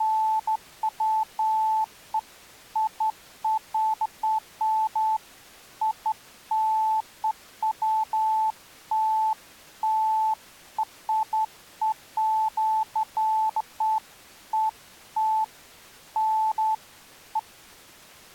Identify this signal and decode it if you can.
Beeps of irregular length. There is no code.